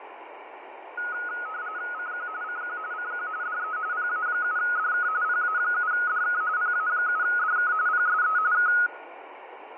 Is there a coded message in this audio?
Yes: RTTY (45.45 baud, 170 Hz shift) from 1.0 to 8.9 s, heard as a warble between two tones, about 1360 Hz centre, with radio static and fading. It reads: CQ CQ CQ DE PA7DK PA7DK PA7DK PSE K